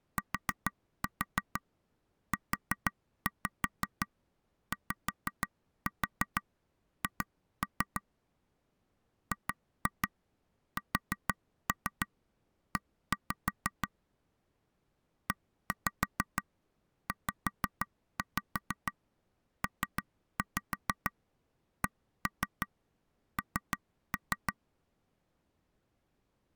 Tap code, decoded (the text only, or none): TUYH GSE EZPCN